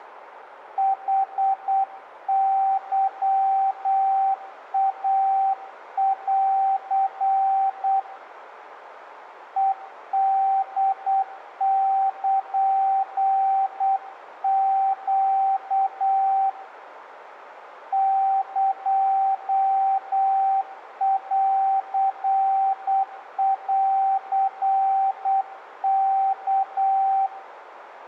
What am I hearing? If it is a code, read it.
Morse code (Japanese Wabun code), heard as a keyed tone, hand-sent with a paddle, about 8 wpm, 780 Hz, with radio static and room echo. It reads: ヌケイン ヘホルネ エンンワ